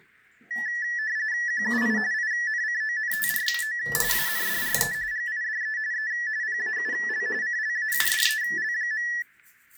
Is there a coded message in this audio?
Yes: RTTY (45.45 baud, 170 Hz shift) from 0.5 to 9.2 s, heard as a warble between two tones, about 1850 Hz centre, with the noise of a restroom. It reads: QUI INCONTRO ANDRE GIDE E PAUL CLAUDEL.